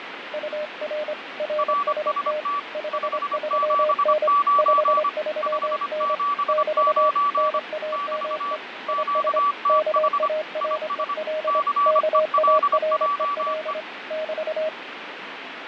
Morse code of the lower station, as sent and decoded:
..- .-. / .-. ... - / ..... ...-- -. / ..... ...-- -. / -...- / -. .- -- . / .. ... / -.- .- .-. . .-.. / -.- .- .-. . .-.. / -...-
UR RST 53N 53N <BT> NAME IS KAREL KAREL <BT>

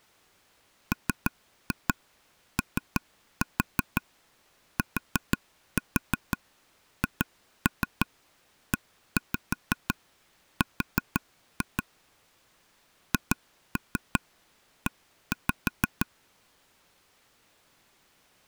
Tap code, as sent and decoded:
3-2 3-4 4-4 2-3 1-5 4-2 / 2-3 1-5
MOTHER HE

